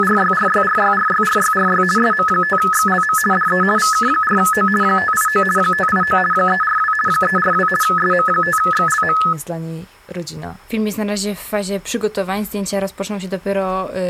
RTTY (50 baud, 450 Hz shift), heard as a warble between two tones, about 1500 Hz centre. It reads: … SM5XLM DE VK4O 589 589 342 342 SM5XLM